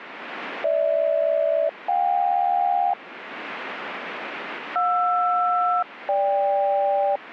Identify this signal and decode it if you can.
Aircraft SELCAL, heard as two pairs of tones. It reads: GH-JK JR-GK